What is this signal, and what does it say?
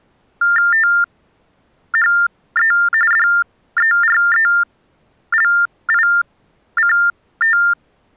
TTY/TDD text telephone tones (45.45 baud Baudot), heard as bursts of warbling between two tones, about 400 Hz shift, 1600 Hz centre. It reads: THE DERELICT